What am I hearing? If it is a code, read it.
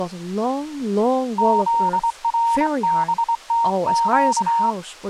Morse code, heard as a keyed tone, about 23 wpm, 930 Hz, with speech in English. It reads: ZRBTQ